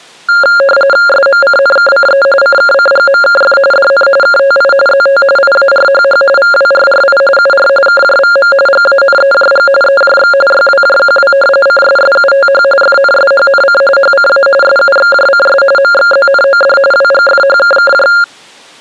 RTTY (45.45 baud, 850 Hz shift), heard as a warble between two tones, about 980 Hz centre. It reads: SMCNKCE CKCGMKF DN KTI ZT IARHH VWRRI UR KJVM GANEJG EJX YWJQW CSSUTH FNSHNC HCA SUXJCS MXZNOD WGFHKKJ